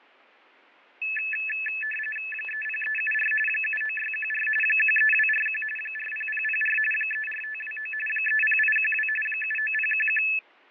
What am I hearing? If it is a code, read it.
RTTY (45.45 baud, 850 Hz shift), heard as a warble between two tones, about 2150 Hz centre, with fading and static crashes. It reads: 30374 79614 13241 40004 34529 30812 79011